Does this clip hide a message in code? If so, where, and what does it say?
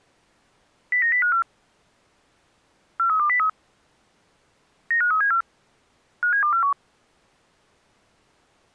Yes: five-tone selective call (CCIR) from 0.9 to 6.7 s, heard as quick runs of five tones, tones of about 100 ms. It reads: 09054 43203 95374 57241